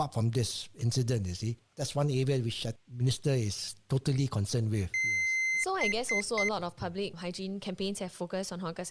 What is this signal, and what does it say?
Beep code, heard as a piezo beeper, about 2050 Hz, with speech in English. 1 long, 3 short. In Award and IBM BIOS tables: video adapter failure; in AMI BIOS tables: memory failure.